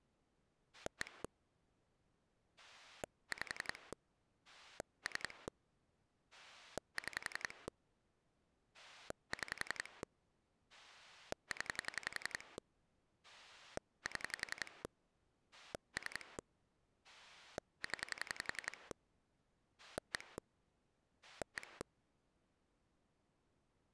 Pulse dialling, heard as a rotary dial, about 11 pulses a second. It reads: 1 5 3 6 6 0 7 3 0 1 1